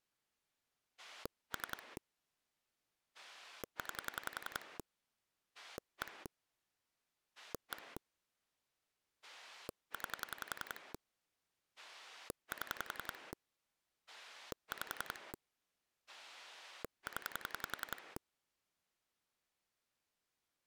Pulse dialling, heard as a rotary dial, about 10 pulses a second. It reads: 3 9 1 1 9 7 5 0